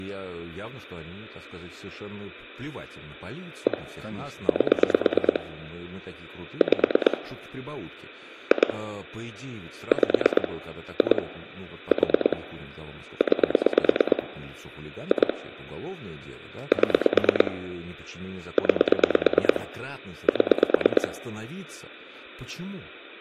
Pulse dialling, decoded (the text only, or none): 1 8 5 2 5 2 4 9 2 7 9 7